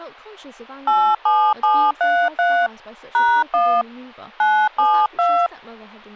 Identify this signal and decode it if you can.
DTMF, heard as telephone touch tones, dialled by hand, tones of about 280 ms, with speech in English. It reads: 87733 #1 972